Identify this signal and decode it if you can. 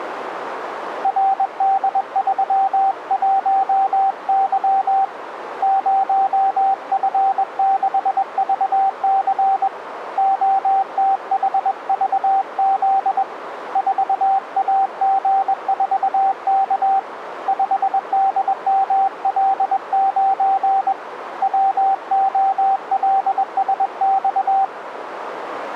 Morse code, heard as a keyed tone, hand-sent with a paddle, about 21 wpm, 780 Hz, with radio static and a narrow filter. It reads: RD31Y 0F6VC OTHVZ 4AG4K 5DML9 WOLSX